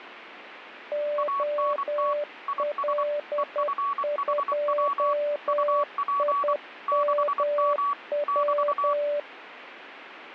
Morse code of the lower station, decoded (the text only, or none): OL2IMW